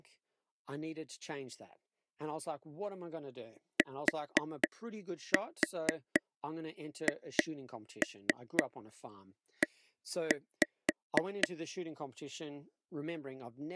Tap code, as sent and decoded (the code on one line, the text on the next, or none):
4-4 2-3 1-5
THE